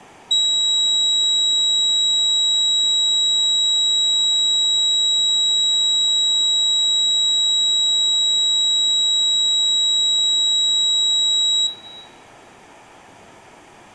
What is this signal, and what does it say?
A steady tone, with room echo. There is no code.